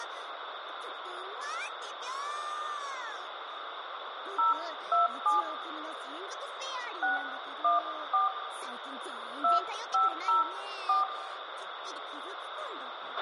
DTMF, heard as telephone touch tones, dialled by hand, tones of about 150 ms, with radio hiss, a squelch burst at the end and room echo. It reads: 027 614 2504